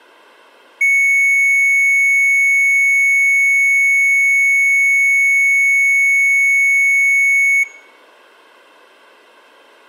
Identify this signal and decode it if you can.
A steady tone, with room echo. There is no code.